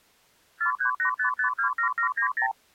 Multi-frequency trunk signalling (R2, with the far end's replies), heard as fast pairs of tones, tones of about 100 ms. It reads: 4385527790